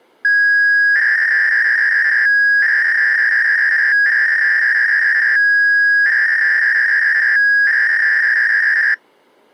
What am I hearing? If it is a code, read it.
300-baud modem data (V.21 tones), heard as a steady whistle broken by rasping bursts, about 300 baud, 200 Hz shift.